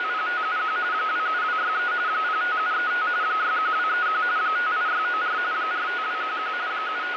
RTTY (45.45 baud, 170 Hz shift), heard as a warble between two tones, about 1360 Hz centre, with radio static. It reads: … 27263 05735 61231 58694 45211 …